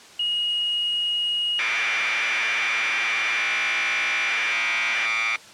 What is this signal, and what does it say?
Commodore tape loading (standard loader), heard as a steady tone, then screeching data.